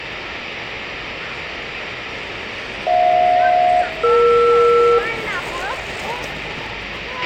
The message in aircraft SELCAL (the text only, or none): HJ-ER